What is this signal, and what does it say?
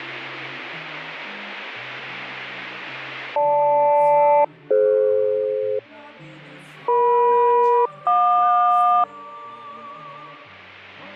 Aircraft SELCAL, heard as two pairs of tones. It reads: GL-DF EM-JQ